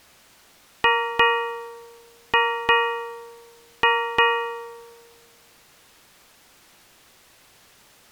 Ship's bell, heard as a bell. 6. Six half-hours of the watch have passed.